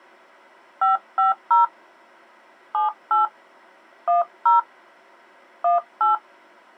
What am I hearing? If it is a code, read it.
DTMF, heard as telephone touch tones, dialled by hand, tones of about 140 ms. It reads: 550 78 10 18